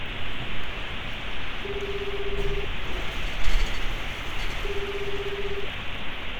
Telephone call progress tone (Japanese plan), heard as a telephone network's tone, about 380, 400, 420 Hz, 1 s on and 2 s off, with phone line noise and street noise. Ringback tone.